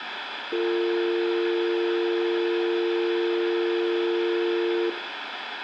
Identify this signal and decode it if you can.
Telephone call progress tone (North American or UK plan), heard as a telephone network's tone, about 350, 450 Hz, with phone line noise and room echo. Dial tone.